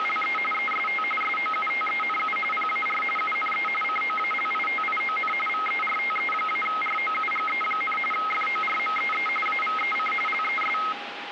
RTTY (45.45 baud, 850 Hz shift), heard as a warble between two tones, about 1700 Hz centre, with radio static. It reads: … EST SOUTENU PAR UNE COALITION VERTE-ROUGE, FORMEE AVEC LES